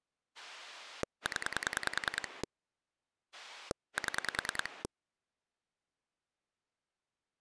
Pulse dialling, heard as a rotary dial, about 10 pulses a second. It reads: 0 7